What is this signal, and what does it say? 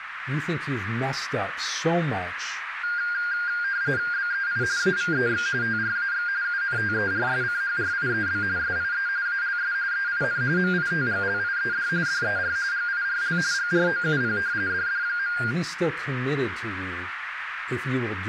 RTTY (45.45 baud, 170 Hz shift), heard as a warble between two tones, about 1500 Hz centre, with radio static, a narrow filter and speech in English. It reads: BEI AVEX TRAX UNTERSCHRIEB SIE ALS EIN MITGLIED DER GIRL GROUP DD.